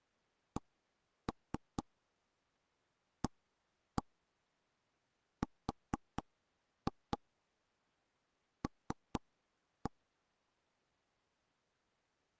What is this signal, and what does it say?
Tap code, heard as knocks on wood, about 4 knocks a second. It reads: CARL